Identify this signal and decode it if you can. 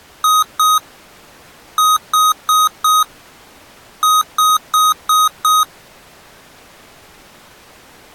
Beep code, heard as beeps from a small speaker, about 1250 Hz. 2-4-5.